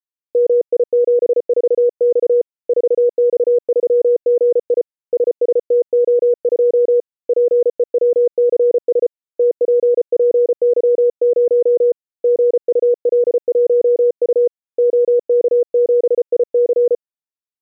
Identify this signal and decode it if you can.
Morse code, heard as a keyed tone, hand-sent with a paddle, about 34 wpm, 480 Hz. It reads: MI74X 4X3GI SSTO2 PEWCS TPPY0 GUL1U OK7IC